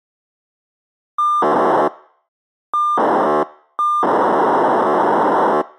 POCSAG pager data (2400 baud), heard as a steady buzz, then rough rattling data.